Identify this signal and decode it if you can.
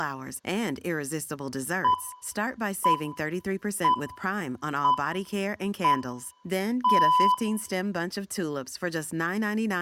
Radio time signal (six pips, as the Greenwich Time Signal), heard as pips, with room echo and speech in English.